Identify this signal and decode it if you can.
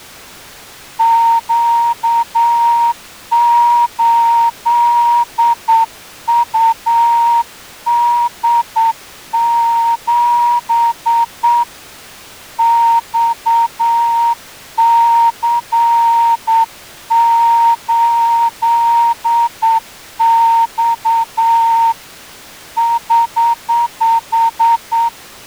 Morse code, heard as a whistle, hand-sent with a straight key, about 8 wpm. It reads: Q8UD7 XC8X <HH>